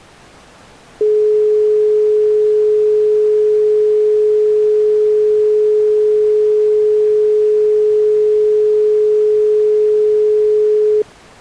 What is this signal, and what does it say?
Telephone call progress tone (425 Hz plan, as in most of Europe), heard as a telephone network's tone, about 420 Hz. Dial tone.